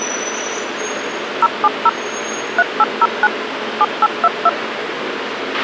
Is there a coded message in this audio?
Yes: DTMF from 1.4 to 4.5 s, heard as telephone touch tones, dialled by machine, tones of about 40 ms, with radio hiss, a squelch burst at the end and street noise. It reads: 070 3809 7822